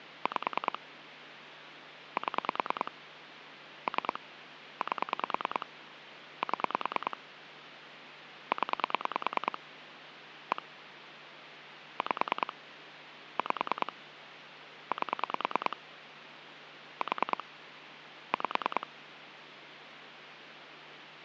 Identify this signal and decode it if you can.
Pulse dialling, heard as clicks on a phone line, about 9 pulses a second, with phone line noise. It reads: 5 7 3 8 7 0 1 5 5 8 4 5